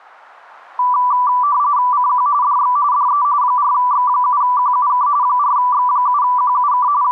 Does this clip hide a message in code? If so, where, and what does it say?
Yes: RTTY (45.45 baud, 170 Hz shift) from 0.8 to 7.1 s, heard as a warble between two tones, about 1080 Hz centre. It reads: CQ DX DE 4X7QUK 4X7QUK …